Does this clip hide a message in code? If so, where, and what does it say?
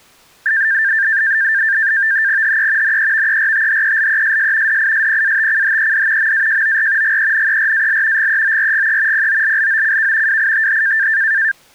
Yes: NAVTEX (SITOR-B), 100 baud, 170 Hz shift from 0.5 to 11.5 s, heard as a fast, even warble, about 1700 Hz centre. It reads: HE NEVERTHELESS DISPATCHED MAJOR GENERAL GEORGE POLLOCK WITH